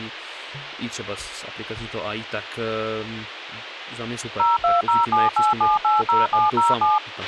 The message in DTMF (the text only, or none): 02078780707